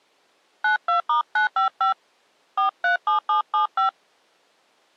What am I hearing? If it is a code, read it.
DTMF, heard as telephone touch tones, dialled by hand, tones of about 120 ms. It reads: 92*955 437775